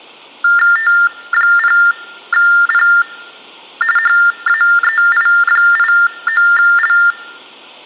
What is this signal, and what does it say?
TTY/TDD text telephone tones (45.45 baud Baudot), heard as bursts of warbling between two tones, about 400 Hz shift, 1600 Hz centre. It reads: T0P HAEI89L